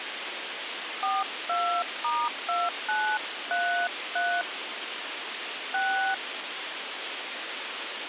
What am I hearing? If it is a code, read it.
DTMF, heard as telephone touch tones, dialled by hand, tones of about 290 ms, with radio hiss. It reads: 42*2933 6